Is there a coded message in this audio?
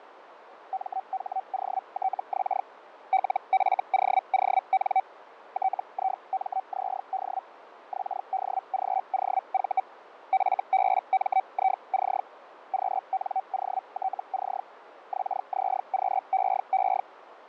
Yes: Hellschreiber (Feld-Hell, 122.5 baud) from 0.7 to 17.0 s, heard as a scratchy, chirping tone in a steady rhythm, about 760 Hz, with radio static and fading. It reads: MHOTX LFOON TIMZD XDGOV FBMIC QNOTC XZQEE